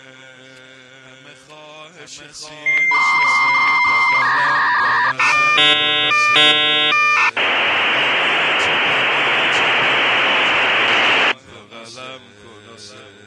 Dial-up modem handshake (V.34 or later), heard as a whistle, warbles, then hiss.